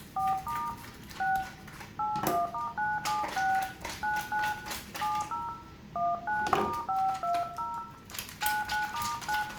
DTMF, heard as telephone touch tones, dialled by hand, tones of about 200 ms, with room echo and the noise of a restroom. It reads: 4* 6 81*976 99 70 19*520 99*9